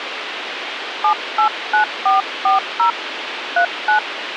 DTMF, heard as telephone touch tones, dialled by hand, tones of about 120 ms, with radio hiss. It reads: 789440 39